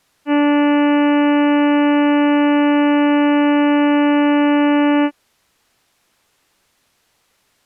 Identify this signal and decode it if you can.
Ship horn signal, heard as a ship's horn, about 290 Hz. 1 long. At sea: a vessel nearing a blind bend, or under power and making way in fog.